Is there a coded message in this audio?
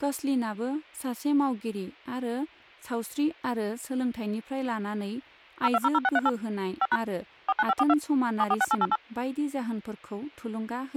Yes: DTMF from 5.6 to 9.0 s, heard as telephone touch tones, dialled by machine, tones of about 40 ms, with hum and speech in Bodo. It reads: 0200638 5# 49542 746888